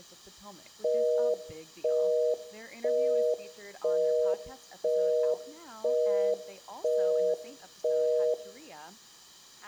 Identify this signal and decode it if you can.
Telephone call progress tone (North American plan), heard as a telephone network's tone, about 480, 620 Hz, 0.5 s on and 0.5 s off, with room echo and speech in English. Busy tone.